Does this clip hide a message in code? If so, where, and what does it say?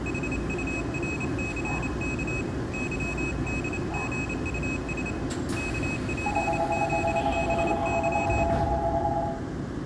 Yes: Morse code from 0.0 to 8.5 s, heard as a high beeper, hand-sent with a paddle, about 28 wpm, 2550 Hz, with room echo and the noise inside a subway train. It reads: HURCK YDGUS KPZBY